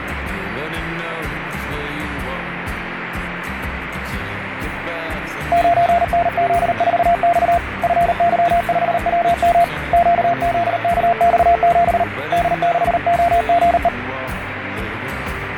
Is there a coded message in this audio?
Yes: Morse code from 5.5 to 13.9 s, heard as a keyed tone, hand-sent with a paddle, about 38 wpm, 690 Hz, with radio static. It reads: 9NZ4X FY5WM QZKX7 D6OGE